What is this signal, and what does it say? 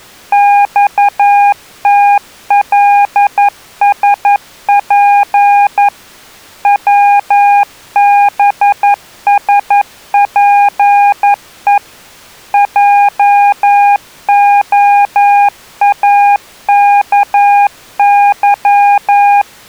Morse code, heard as a keyed tone, machine-sent, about 11 wpm, 810 Hz. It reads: XTLSP WBSPE JOAKY